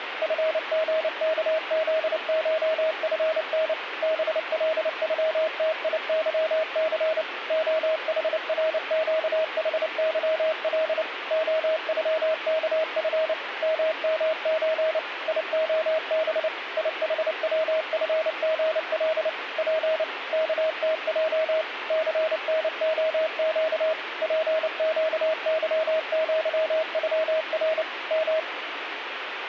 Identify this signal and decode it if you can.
Morse code (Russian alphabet), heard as a keyed tone, machine-sent, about 29 wpm, 640 Hz, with radio static. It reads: ФГКЗШФН БЛЮТИЫЦ ОХРЩХЫЛ ОЮКФ ММЧ ИОБ ИХВФГЛ П КТЙ ЦНОЩ ПЩЫЪЮР М